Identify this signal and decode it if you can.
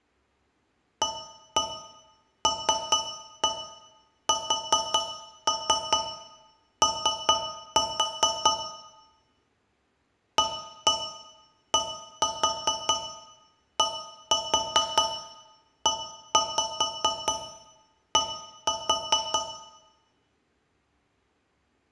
Tap code, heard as taps on a metal pipe, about 4 knocks a second, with room echo. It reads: ALSO ADDED